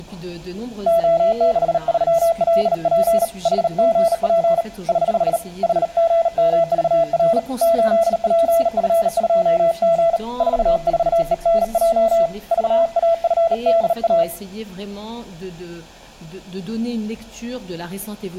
Morse code, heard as a keyed tone, hand-sent with a bug key, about 38 wpm, 670 Hz. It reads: O63LP HGP <HH> HGMVR 8PF2G 44ENJ VAFDA